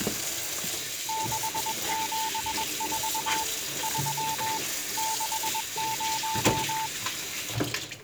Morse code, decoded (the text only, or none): 674 3 60